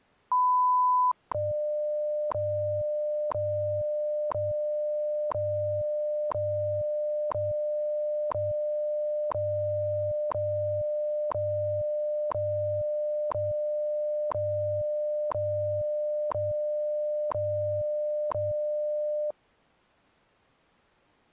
Radio time signal (WWV, Colorado), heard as ticks, one a second.